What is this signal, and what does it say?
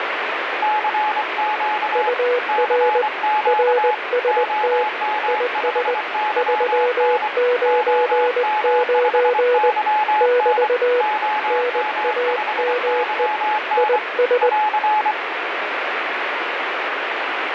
Morse code, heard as two keyed tones, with radio static. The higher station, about 24 wpm, 850 Hz: CQ CQ OM5YN OM5YN OM5YN <AR>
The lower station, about 20 wpm, 490 Hz: UR RST IS 399 <BT> NAME IS